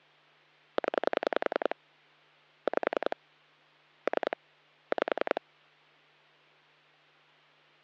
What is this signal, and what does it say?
Pulse dialling, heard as clicks on a phone line, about 10 pulses a second, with hum. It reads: 0 5 3 5